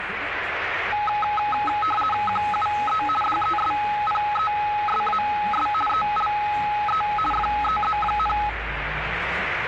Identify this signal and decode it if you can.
RTTY (50 baud, 450 Hz shift), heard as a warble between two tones, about 1060 Hz centre, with radio static and the noise inside a bus. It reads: QUE DESPESAS ELE FEZ,